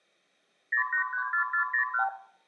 Multi-frequency trunk signalling (R2, with the far end's replies), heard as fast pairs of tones, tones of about 100 ms, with room echo. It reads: 0834401